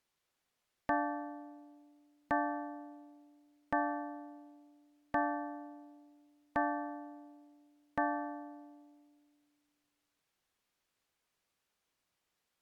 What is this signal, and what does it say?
Clock strike, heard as a bell. 6. Six o'clock.